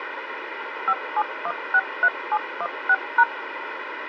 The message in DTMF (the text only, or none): 57163716#